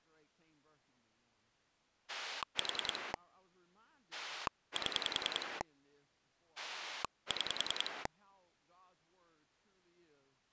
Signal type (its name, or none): pulse dialling